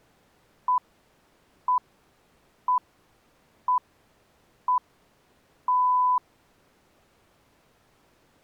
Radio time signal (six pips, as the Greenwich Time Signal), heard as pips.